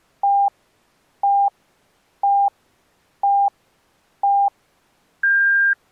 Radio time signal (five pips and a higher one, as on Chinese radio), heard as pips.